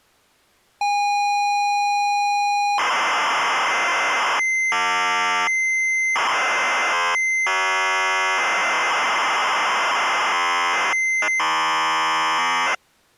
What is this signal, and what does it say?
ZX Spectrum tape loading, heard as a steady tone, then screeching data.